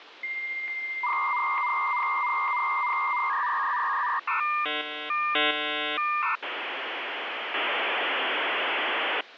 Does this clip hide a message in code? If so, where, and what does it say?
Yes: dial-up modem handshake (V.34 or later) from 0.2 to 9.2 s, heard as a whistle, warbles, then hiss, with phone line noise.